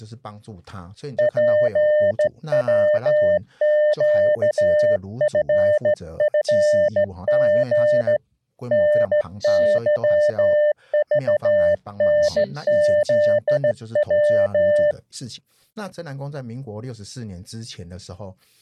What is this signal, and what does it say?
Morse code, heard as a keyed tone, hand-sent with a straight key, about 15 wpm, 600 Hz, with speech in Chinese. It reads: PWQFFG NYVNZW